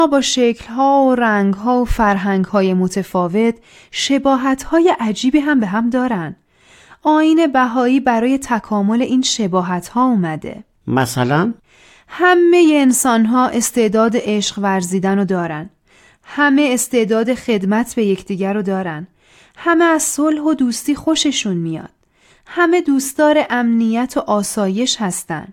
Speech in Persian. There is no code.